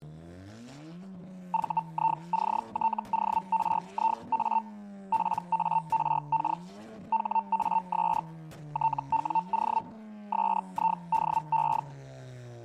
Hellschreiber (Feld-Hell, 122.5 baud), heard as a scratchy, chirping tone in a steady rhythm, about 900 Hz. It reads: VICTORIA PARK HAS TWO SIDE